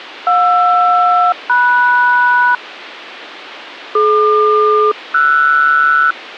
Aircraft SELCAL, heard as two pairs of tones. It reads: JR-MS DQ-RS